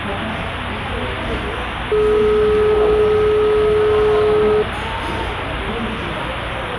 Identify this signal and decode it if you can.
Telephone call progress tone (425 Hz plan, as in most of Europe), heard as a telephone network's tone, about 420 Hz, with phone line noise and the noise of a cafe. Dial tone.